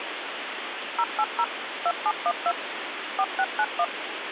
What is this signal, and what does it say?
DTMF, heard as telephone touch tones, dialled by machine, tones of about 60 ms, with phone line noise. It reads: 080 2712 4691